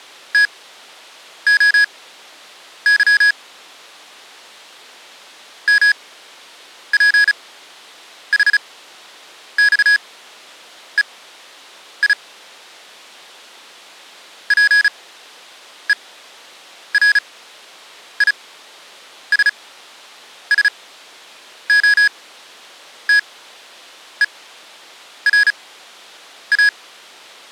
Morse code (Greek alphabet), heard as electronic beeps, machine-sent, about 35 wpm, spaced as for 8 wpm, 1650 Hz. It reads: ΤΟΥ ΜΠΗΞΕΙ ΠΕΡΙΣΣΟΤΕΡΑ